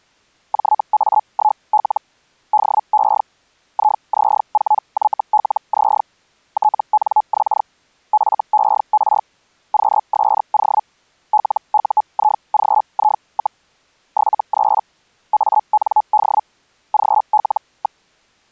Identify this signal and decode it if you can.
Hellschreiber (Feld-Hell, 122.5 baud), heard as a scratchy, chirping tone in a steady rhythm, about 850 Hz. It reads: JA1L DE IZ4YLZ TNX FER QSO LUIGI, 73 AND GL.